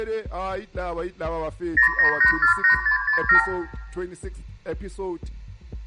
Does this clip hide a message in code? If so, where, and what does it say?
Yes: multi-frequency trunk signalling (R2, with the far end's replies) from 1.8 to 3.5 s, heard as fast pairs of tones, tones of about 110 ms, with room echo. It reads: 09848667